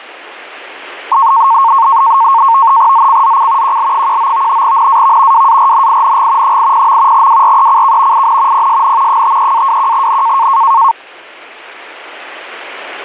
NAVTEX (SITOR-B), 100 baud, 170 Hz shift, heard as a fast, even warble, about 1000 Hz centre. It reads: ZCZC QL19 NAV WARNING 80. WRECK IN PSN 53-21N